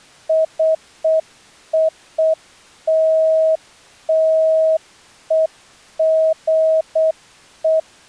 Morse code (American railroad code), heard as a keyed tone, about 640 Hz. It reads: COLLEGE